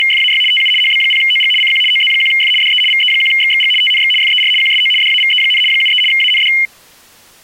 RTTY (75 baud, 850 Hz shift), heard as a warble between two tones, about 2550 Hz centre. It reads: … TU HB0OG CQ OZ1F DE VE1XXG TNX FER QSO DAVE, 73 AND